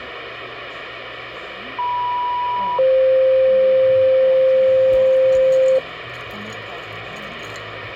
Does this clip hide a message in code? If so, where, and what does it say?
Yes: two-tone page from 1.8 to 5.8 s, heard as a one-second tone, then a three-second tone, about 980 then 520 Hz, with radio hiss and the noise of a cafe.